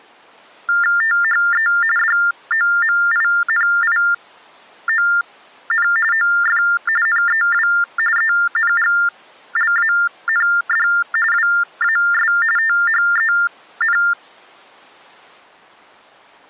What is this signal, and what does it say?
TTY/TDD text telephone tones (45.45 baud Baudot), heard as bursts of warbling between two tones, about 400 Hz shift, 1600 Hz centre. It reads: THE DOMINION OF NEW ENGLAND WAS THEN